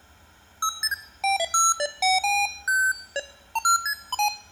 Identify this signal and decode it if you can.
Electronic bleeps of random pitch and length, with room echo. There is no code.